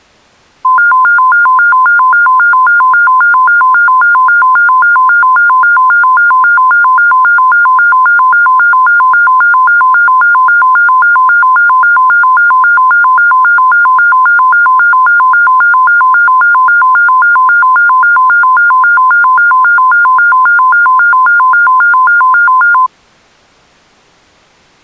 A tone that alternates evenly between two pitches. There is no code.